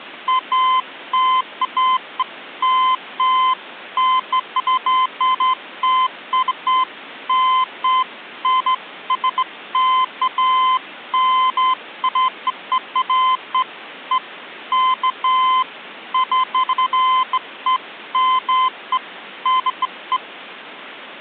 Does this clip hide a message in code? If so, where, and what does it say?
No, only beeps of irregular length.